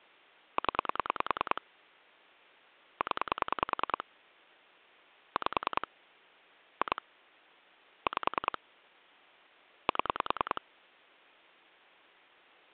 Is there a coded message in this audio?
Yes: pulse dialling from 0.6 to 10.6 s, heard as clicks on a phone line, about 10 pulses a second. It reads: 0 0 5 2 5 7